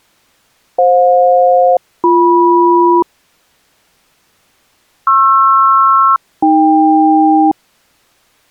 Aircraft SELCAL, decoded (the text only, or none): FJ-BM PR-AK